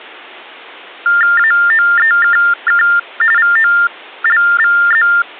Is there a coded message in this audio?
Yes: TTY/TDD text telephone tones (45.45 baud Baudot) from 1.1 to 5.2 s, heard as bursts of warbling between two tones, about 400 Hz shift, 1600 Hz centre. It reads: AOEKK VOLVZ